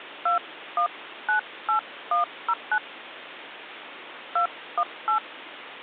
DTMF, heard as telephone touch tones, dialled by hand, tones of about 90 ms, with phone line noise. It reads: 2198109 218